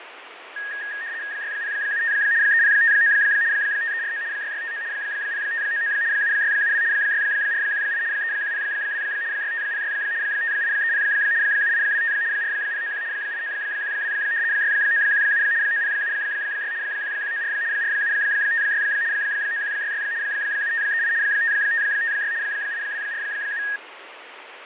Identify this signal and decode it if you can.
RTTY (75 baud, 170 Hz shift), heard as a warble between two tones, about 1750 Hz centre, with radio static and fading. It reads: 6075 3059 5349 6659 0599 7672 6418 3102 6506 5830 7825 4091 8912 6917 9076 1194 4756 9166 7538 5556 8247